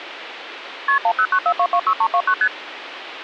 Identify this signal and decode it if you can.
Multi-frequency trunk signalling (R1, as on North American trunks), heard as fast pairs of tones, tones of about 70 ms, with phone line noise. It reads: KP 1094226329 ST